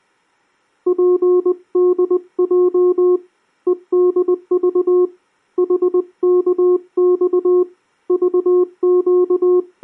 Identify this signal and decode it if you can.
Morse code, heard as a keyed tone, hand-sent with a paddle, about 20 wpm, 360 Hz. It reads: PDJ EDV HKX …